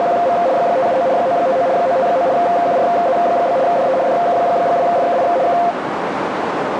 RTTY (75 baud, 170 Hz shift), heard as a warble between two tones, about 610 Hz centre, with radio static and a narrow filter. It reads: … 579 959 959 QRZ? DE DK2FKI K